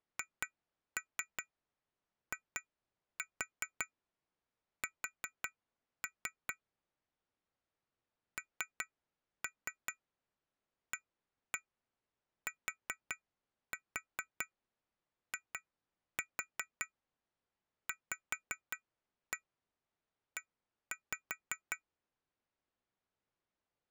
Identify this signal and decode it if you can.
Tap code, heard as taps on glass, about 5 knocks a second. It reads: HIS NATIVE